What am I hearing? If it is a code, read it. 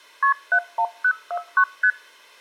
Multi-frequency trunk signalling (R1, as on North American trunks), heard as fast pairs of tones, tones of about 70 ms. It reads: KP 71049 ST